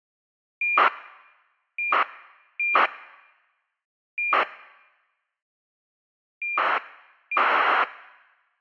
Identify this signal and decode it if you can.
ACARS aircraft data, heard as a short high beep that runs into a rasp, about 2400 baud.